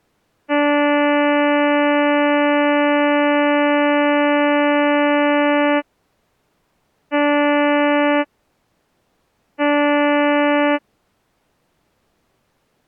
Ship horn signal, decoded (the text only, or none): 1 long, 2 short